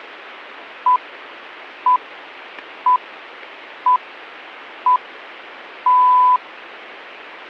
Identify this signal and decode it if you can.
Radio time signal (six pips, as the Greenwich Time Signal), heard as pips.